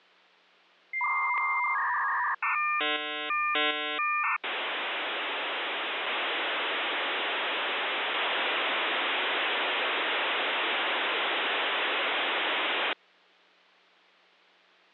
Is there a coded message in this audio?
Yes: dial-up modem handshake (V.34 or later) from 0.9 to 12.9 s, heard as a whistle, warbles, then hiss.